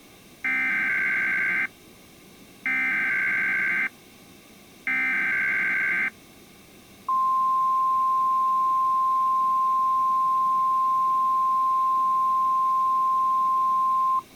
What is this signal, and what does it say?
Emergency Alert System (SAME) tones (header bursts, then the 1050 Hz attention tone), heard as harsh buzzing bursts, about 520.83 baud.